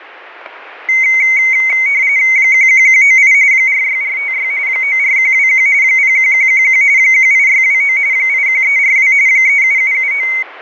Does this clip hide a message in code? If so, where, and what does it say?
Yes: RTTY (45.45 baud, 170 Hz shift) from 0.9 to 10.4 s, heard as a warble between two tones, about 2150 Hz centre, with static crashes. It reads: 11198 46456 94121 01111 18629 81342 37779